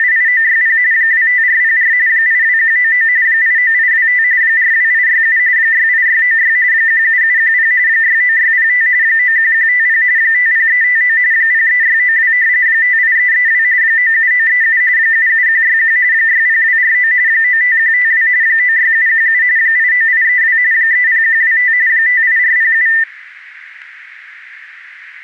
RTTY (45.45 baud, 170 Hz shift), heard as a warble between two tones, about 1900 Hz centre, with radio static and static crashes. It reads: … 25404 82199 89825 42867 68696 17710 69605 91150 50359 03692 58332 97937 77161 60249 95152 96717 89832 30125 58407